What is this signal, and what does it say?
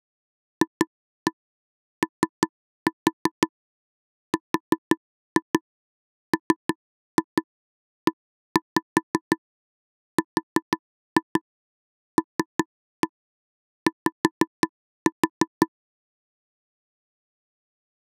Tap code, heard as taps on a table, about 5 knocks a second. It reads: FORMERLY